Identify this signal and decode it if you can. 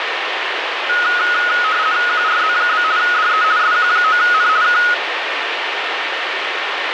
RTTY (50 baud, 170 Hz shift), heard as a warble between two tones, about 1360 Hz centre, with radio static and a steady whistle near 1820 Hz. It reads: QRZ? DE SQ9N K